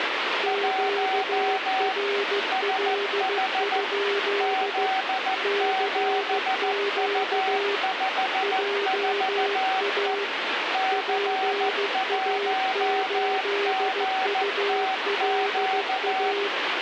Morse code, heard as two keyed tones, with radio static. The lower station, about 15 wpm, 400 Hz: QRL? CQ JA PA8ULA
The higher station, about 14 wpm, 760 Hz: 1 SH Z7U54E C1GTQ